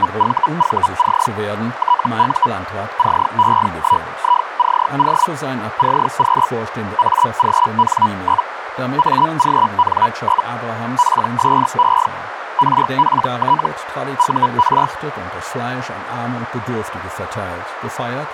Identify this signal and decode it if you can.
Hellschreiber (Feld-Hell, 122.5 baud), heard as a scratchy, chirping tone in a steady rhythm, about 980 Hz, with radio static, a narrow filter and speech in German. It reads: … TU CE1ICO CQ AGN? AGN? PSE RPT UR